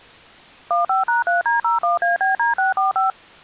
DTMF, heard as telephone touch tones, dialled by machine, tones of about 140 ms. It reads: 15#3D01ABD645